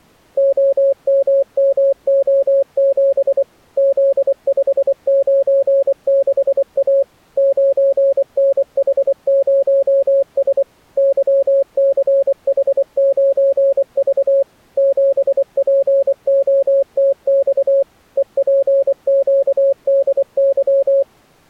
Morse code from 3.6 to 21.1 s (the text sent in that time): Z596A 9NH0S YCH9V 7POTX EPQDY